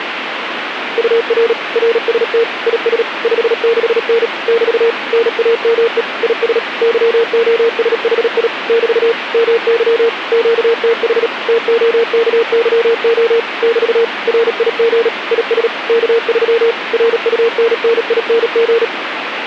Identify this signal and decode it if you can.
Morse code, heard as a keyed tone, machine-sent, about 37 wpm, 460 Hz, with radio static. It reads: UR RST IS 56N <BT> NAME IS YOSHI <BT> MY QTH TOKYO <BT> RIG IS K3 RUNNING